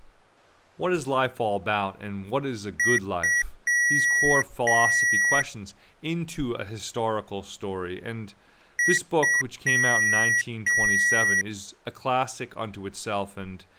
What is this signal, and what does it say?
Beep code, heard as beeps from a small speaker, played twice, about 1950 Hz, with speech in English. 2 short, 2 long.